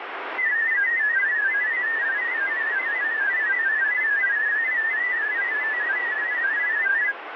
Multi-tone FSK (Olivia or MFSK type), about 500 Hz wide, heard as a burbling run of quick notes, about 31.25 baud, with radio static.